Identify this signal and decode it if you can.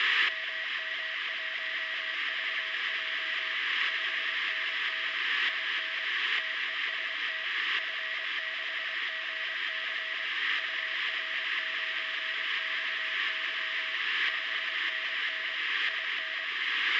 Morse code, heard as a keyed tone, machine-sent, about 24 wpm, 640 Hz, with radio static and room echo. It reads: MM1VJ 5NN IN TEST F6GC UR9XY 5NN IN